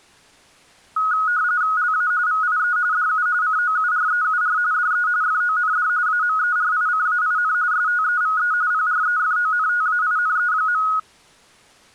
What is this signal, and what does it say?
RTTY (45.45 baud, 170 Hz shift), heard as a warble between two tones, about 1360 Hz centre. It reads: LA VIE DU COUREUR DE FOND AMERICAIN STEVE PREFONTAINE.